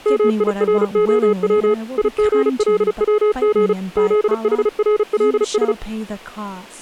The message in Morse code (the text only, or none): MIROW IGLWG ZHRLS